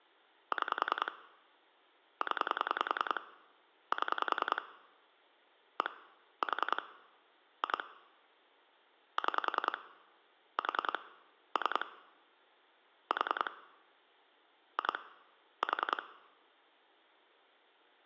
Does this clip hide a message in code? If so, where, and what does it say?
Yes: pulse dialling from 0.5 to 16.0 s, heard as clicks on a phone line, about 10 pulses a second. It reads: 6 0 7 1 4 2 6 4 3 4 2 4